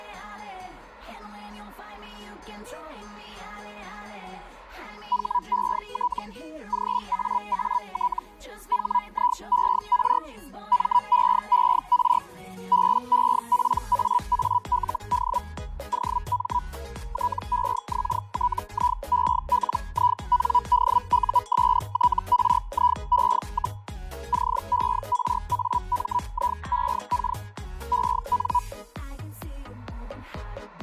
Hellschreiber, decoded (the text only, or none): HET GAAT HIER MEER BEPAALD OM TEXTIELINDUSTRIE, CERAMIEK EN